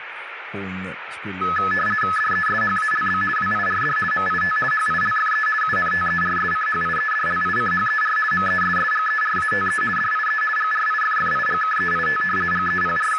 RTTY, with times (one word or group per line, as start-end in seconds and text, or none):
2.2-3.2 DESHALB
3.4-4.0 WIRD
4.1-4.6 MIT
4.7-5.5 HILFE
5.6-8.2 UNTERSCHIEDLICHER
8.3-9.8 MESSGERATE
10.0-10.4 DIE
10.6-12.2 GRIFFIGKEIT
12.5-13.2 …